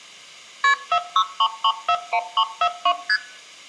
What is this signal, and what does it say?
Multi-frequency trunk signalling (R1, as on North American trunks), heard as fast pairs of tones, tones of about 70 ms. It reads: KP 463341342 ST